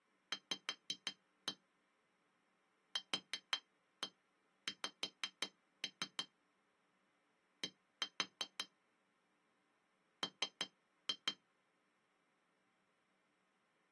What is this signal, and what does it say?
Tap code, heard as taps on glass, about 5 knocks a second. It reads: V QX D M